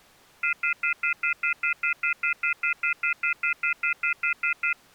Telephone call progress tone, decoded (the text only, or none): off-hook warning tone